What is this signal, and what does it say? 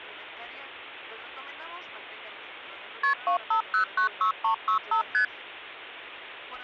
Multi-frequency trunk signalling (R1, as on North American trunks), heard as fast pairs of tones, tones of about 100 ms. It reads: KP 25096365 ST